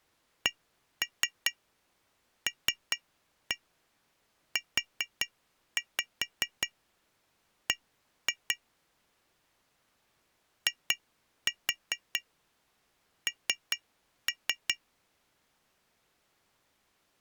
Tap code, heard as taps on glass, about 5 knocks a second. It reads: CLUB IN